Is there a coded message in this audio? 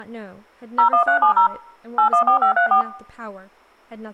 Yes: DTMF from 0.8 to 2.8 s, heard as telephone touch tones, dialled by machine, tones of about 100 ms, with speech in English. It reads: 01370 814534